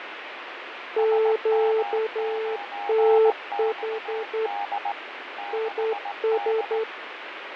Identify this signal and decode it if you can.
Morse code, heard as two keyed tones, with radio static and fading. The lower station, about 10 wpm, 440 Hz: QTH IS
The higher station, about 18 wpm, 810 Hz: SM9XD 6D